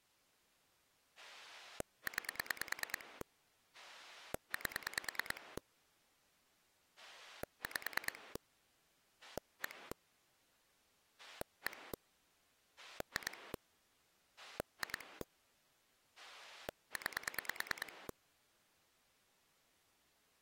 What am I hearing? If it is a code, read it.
Pulse dialling, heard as a rotary dial, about 9 pulses a second. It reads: 9 8 5 1 1 2 2 9